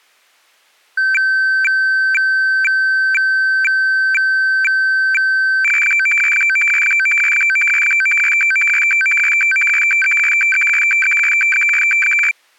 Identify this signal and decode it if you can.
Weather fax (radiofax), 120 lines a minute, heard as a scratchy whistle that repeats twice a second.